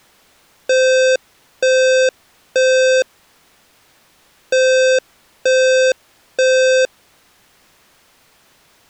Alarm pattern, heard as an alarm's beeps, played twice, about 520 Hz. Temporal three. Smoke or fire, evacuate.